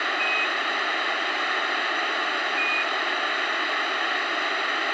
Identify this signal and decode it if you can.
Quindar tones, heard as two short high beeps, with radio hiss.